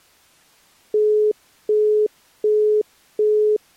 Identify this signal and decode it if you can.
Telephone call progress tone (as in the UK, Australia and similar networks), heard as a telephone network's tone, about 420 Hz, 0.375 s on and 0.375 s off. Busy tone.